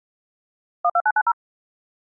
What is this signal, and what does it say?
DTMF, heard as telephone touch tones, dialled by machine, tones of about 50 ms. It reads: 12990